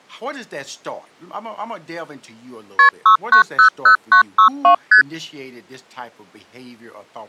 Multi-frequency trunk signalling (R1, as on North American trunks), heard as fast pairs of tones, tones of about 100 ms, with speech in English. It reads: KP 6900962 ST